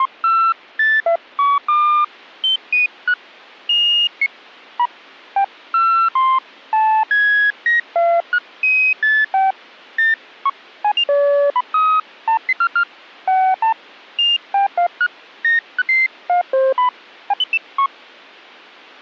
Electronic bleeps of random pitch and length. There is no code.